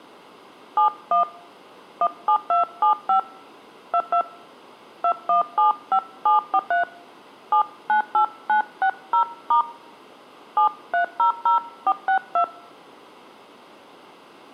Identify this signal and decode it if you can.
DTMF, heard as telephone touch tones, dialled by hand, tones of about 100 ms. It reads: 71 17275 22 2175743 798960* 7300462